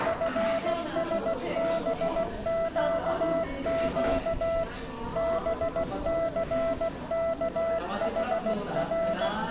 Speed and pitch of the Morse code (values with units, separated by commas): 16 wpm, 660 Hz